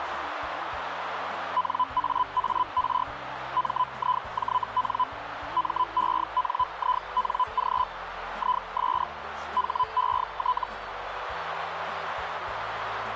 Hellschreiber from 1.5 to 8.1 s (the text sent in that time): NAAR MIJN MENING